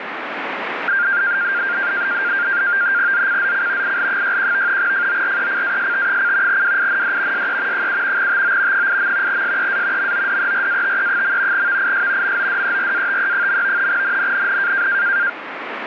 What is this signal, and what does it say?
NAVTEX (SITOR-B), 100 baud, 170 Hz shift, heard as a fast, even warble, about 1500 Hz centre, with radio static. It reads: ZCZC IL61 FORECAST: WIND SE 7 TO 8. SEA MODERATE. VIS MODERATE. NNNN